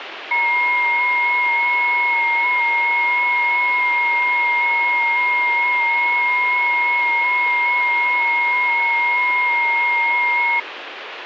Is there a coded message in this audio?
Yes: FT8 (several signals at once) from 0.3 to 10.6 s, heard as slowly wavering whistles, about 6.25 baud, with radio static.